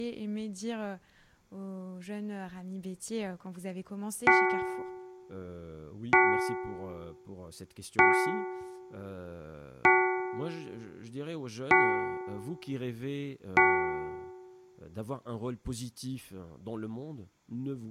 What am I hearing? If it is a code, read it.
Clock strike, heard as a bell, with speech in French. 6. Six o'clock.